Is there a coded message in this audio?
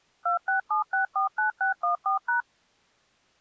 Yes: DTMF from 0.3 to 2.4 s, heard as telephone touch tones, dialled by machine, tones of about 120 ms. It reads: 267649614#